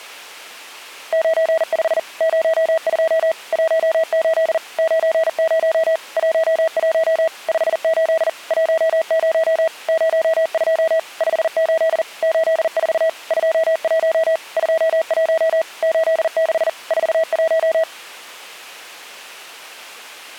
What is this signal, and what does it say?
Morse code, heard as a keyed tone, machine-sent, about 40 wpm, 650 Hz. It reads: 95 02 18 90 11 58 10 02 58 84 21 21 86 41